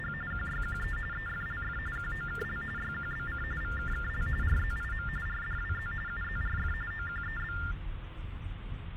TTY/TDD text telephone tones (45.45 baud Baudot), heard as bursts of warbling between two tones, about 400 Hz shift, 1600 Hz centre, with phone line noise and the noise inside a car. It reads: … QYQE EFLF QOKL YQBC VKKL RZIM RDWZ UZRF OQEB